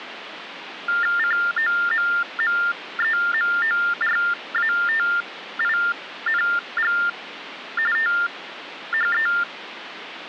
TTY/TDD text telephone tones (45.45 baud Baudot), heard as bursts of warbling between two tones, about 400 Hz shift, 1600 Hz centre, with phone line noise. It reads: COMMEMORATING THE